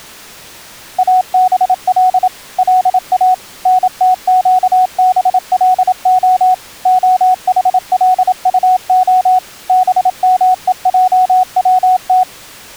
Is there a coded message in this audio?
Yes: Morse code (Hebrew alphabet) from 0.9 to 12.3 s, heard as a keyed tone, machine-sent, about 27 wpm, 740 Hz. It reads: אבל לא נתקבלה החלטה במועצת